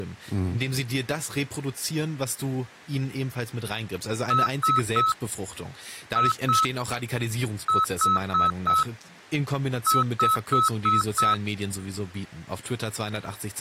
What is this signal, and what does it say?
Beep code, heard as beeps, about 1300 Hz, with speech in German. 3-2-4-5.